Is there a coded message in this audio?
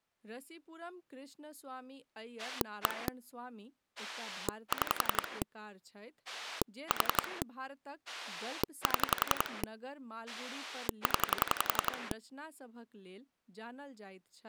Yes: pulse dialling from 2.4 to 12.1 s, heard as a rotary dial, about 11 pulses a second, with speech in Maithili. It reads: 1 6 4 7 0